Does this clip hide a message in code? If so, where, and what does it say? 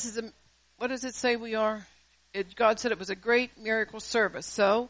No.